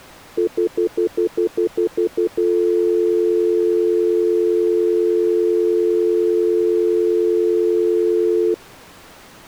Telephone call progress tone (North American plan), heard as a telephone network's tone, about 350, 440 Hz, 0.1 s on and 0.1 s off. Stutter dial tone.